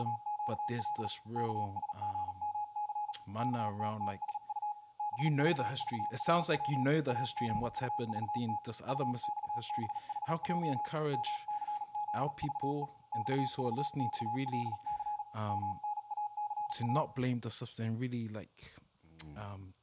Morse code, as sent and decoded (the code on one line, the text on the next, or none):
… / -.- ... --. -- -.-. / -.- - - ... ..- / -... ...- ...- .-. .-- / .- --. ..- ...- - / ..- -..- -... .... .--- / -- -.-. --.. ...- . / -..- ...- -..- .-.. -.-. / -- -. .- -.-. .-
… KSGMC KTTSU BVVRW AGUVT UXBHJ MCZVE XVXLC MNACA